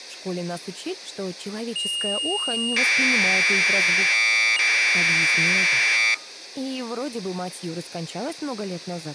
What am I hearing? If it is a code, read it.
Commodore tape loading (standard loader), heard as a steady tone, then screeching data.